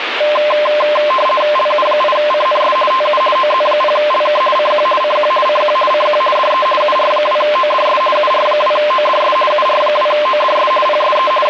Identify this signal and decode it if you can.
RTTY (50 baud, 450 Hz shift), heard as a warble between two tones, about 820 Hz centre, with radio static. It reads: LU8CNS TU OZ0LK CQ CQ CQ CQ DE UR2ODS UR2ODS UR2ODS PSE …